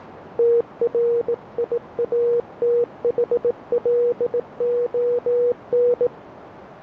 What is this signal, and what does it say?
Morse code, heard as a keyed tone, hand-sent with a bug key, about 18 wpm, 480 Hz, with radio static. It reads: TRIATHLON